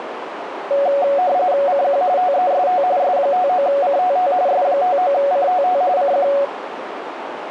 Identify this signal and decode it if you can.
RTTY (45.45 baud, 170 Hz shift), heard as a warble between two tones, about 650 Hz centre, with radio static and a narrow filter. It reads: CQ TEST S59CTT S59CTT CQ